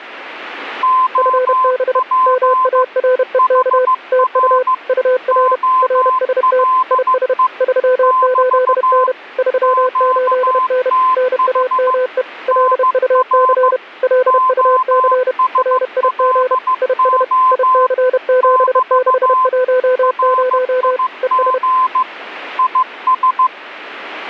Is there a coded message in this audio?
Yes: Morse code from 0.8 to 23.5 s, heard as two keyed tones. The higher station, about 15 wpm, 1030 Hz: OP HR OLE <BT> QTH NR OSLO <BT> RIG IS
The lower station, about 31 wpm, 510 Hz: FB MAREK TU UR RST IS 38N 38N NAME LUC LUC RIG IS IC7610 ES